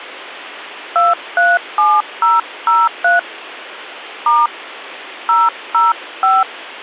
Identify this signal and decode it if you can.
DTMF, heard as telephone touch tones, dialled by hand, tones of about 190 ms. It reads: 237003 * 005